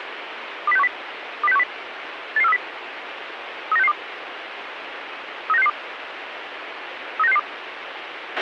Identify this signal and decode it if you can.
Five-tone selective call (EEA), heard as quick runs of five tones, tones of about 40 ms, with radio hiss and a squelch burst at the end. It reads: 20610 20610 88430 39662 39662 39662